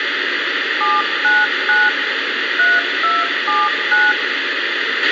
DTMF, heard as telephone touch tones, dialled by machine, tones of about 200 ms, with radio hiss, a squelch burst at the end and room echo. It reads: 799 3279